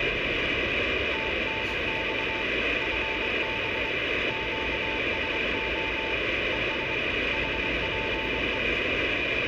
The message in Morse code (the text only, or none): TNX FB QSO ES HPE